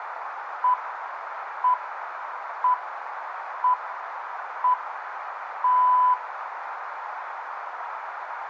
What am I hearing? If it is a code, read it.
Radio time signal (six pips, as the Greenwich Time Signal), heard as pips, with radio static and a narrow filter.